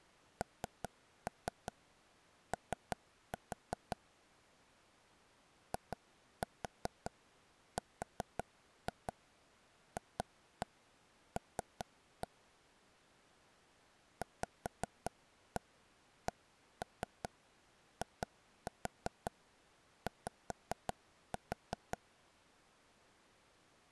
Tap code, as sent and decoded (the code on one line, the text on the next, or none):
3-3 3-4 / 2-4 4-2 2-1 3-1 / 5-1 1-3 2-4 5-4
NO IRFL VCIY